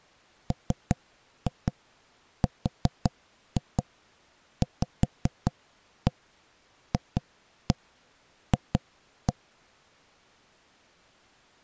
Tap code, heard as knocks on wood, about 5 knocks a second. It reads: MRVFF